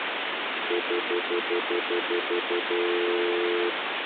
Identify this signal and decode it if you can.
Telephone call progress tone (North American plan), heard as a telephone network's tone, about 350, 440 Hz, 0.1 s on and 0.1 s off, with phone line noise. Stutter dial tone.